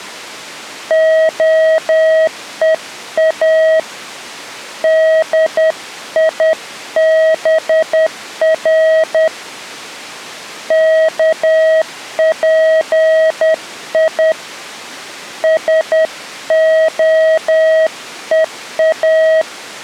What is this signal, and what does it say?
Morse code (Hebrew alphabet), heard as a keyed tone, hand-sent with a paddle, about 10 wpm, 640 Hz. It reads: הוא דיבר כפי שהוא